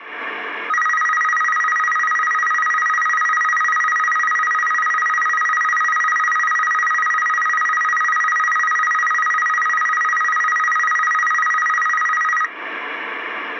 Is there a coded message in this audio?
No, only a tone that alternates evenly between two pitches.